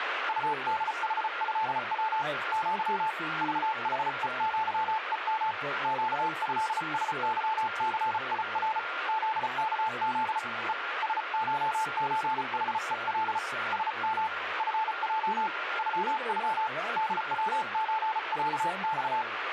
Morse code (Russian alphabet), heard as a keyed tone, hand-sent with a paddle, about 34 wpm, 880 Hz, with radio static, a weaker station near 1400 Hz and speech in English. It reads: УДХЭВ Ъ ЖХЕЪЕМ ЩЭСЫЦИР ЗКЗ Е СШЧХЕЛ СМ ФЙ ЮЮ ДВЧЯЬ